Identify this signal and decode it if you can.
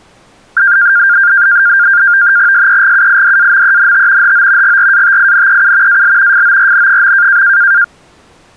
NAVTEX (SITOR-B), 100 baud, 170 Hz shift, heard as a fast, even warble, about 1500 Hz centre. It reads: SEGUIDAMENT HO GRATINEU AL FORN.